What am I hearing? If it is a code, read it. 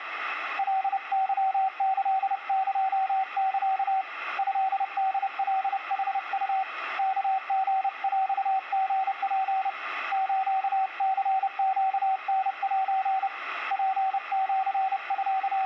Morse code (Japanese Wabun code), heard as a keyed tone, hand-sent with a paddle, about 30 wpm, 770 Hz, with radio static and room echo. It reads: カケキエサ トホカヌウ ワリヰリツ スニネタセ …